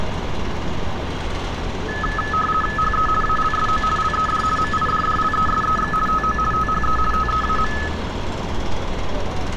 RTTY (50 baud, 450 Hz shift), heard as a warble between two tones, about 1500 Hz centre, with radio static and street noise. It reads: HE ALSO LED MIDDLESEX TO THE TEAM